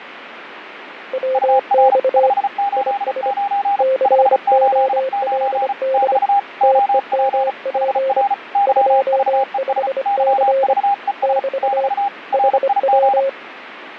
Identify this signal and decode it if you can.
Morse code, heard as two keyed tones, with radio static. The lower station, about 25 wpm, 530 Hz: WX IS COLD TEMP 25C <BT> HW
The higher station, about 35 wpm, 800 Hz: UR 589 589 <BT> OP HR YVES YVES <BT> RIG